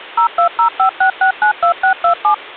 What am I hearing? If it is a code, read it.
DTMF, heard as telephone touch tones, dialled by machine, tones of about 100 ms. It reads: 02056692627